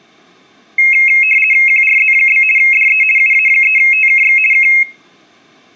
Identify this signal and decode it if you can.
RTTY (50 baud, 450 Hz shift), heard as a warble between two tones, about 2350 Hz centre, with room echo. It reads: QRZ? DE UA3TKX K